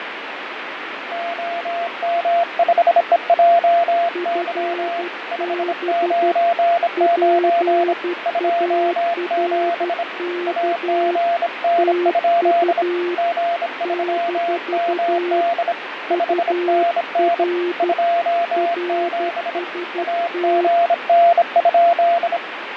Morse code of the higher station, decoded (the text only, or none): OM5EJY 599 27 AGN? G3MD 5NN 27 AGN?